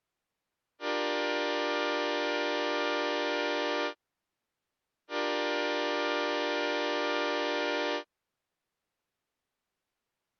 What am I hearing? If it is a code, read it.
Train horn signal, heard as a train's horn. 2 long. On North American railways: brakes released, proceed.